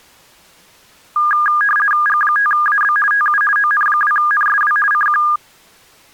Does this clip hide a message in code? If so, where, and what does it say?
Yes: RTTY (50 baud, 450 Hz shift) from 1.2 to 5.4 s, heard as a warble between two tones, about 1430 Hz centre. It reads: G5AB TU ON2NSW CQ